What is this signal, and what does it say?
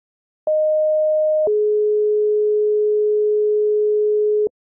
Two-tone page, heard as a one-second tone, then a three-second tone, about 620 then 420 Hz.